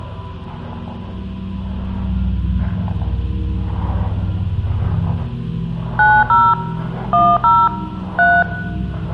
DTMF, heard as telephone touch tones, dialled by hand, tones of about 240 ms, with room echo. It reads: 90 10 3